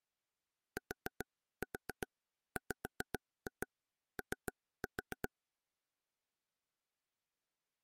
Tap code, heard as taps on a table, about 7 knocks a second. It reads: TWO